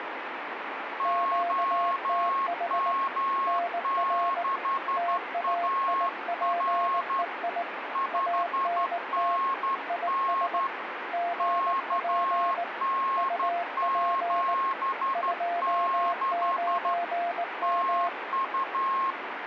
Morse code, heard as two keyed tones, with radio static. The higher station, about 12 wpm, 1080 Hz: OM6AR 5NN KN76 TU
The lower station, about 19 wpm, 690 Hz: QTH NR TAIPEI ANT IS GP UP 29M